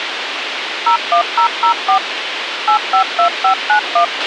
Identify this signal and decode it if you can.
DTMF, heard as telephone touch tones, dialled by machine, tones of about 100 ms, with radio hiss and a squelch burst at the end. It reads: 01004 852591